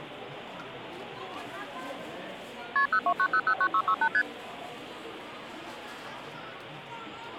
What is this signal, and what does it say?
Multi-frequency trunk signalling (R1, as on North American trunks), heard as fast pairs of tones, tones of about 70 ms, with the noise of a crowd indoors. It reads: KP 029009668 ST